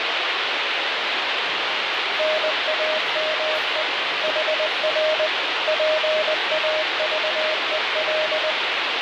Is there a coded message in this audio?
Yes: Morse code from 2.1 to 8.6 s, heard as a keyed tone, machine-sent, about 20 wpm, 620 Hz, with heavy radio static and the noise of a cafe. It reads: NAME HR PAVEL